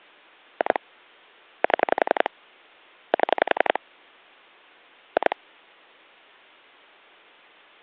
Pulse dialling, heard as clicks on a phone line, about 11 pulses a second. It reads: 2 7 7 2